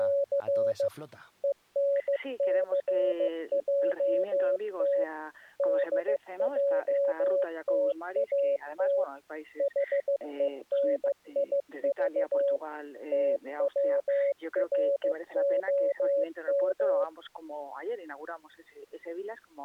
Morse code, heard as a keyed tone, machine-sent, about 15 wpm, 560 Hz. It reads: … ENCJT DJTAT HENIV TWROM